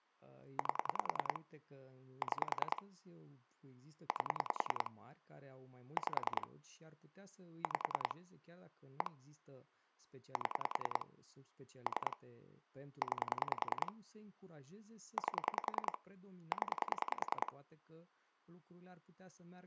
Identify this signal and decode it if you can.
Pulse dialling, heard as clicks on a phone line, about 10 pulses a second, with speech in Romanian. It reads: 8 6 8 5 5 1 7 3 9 8 0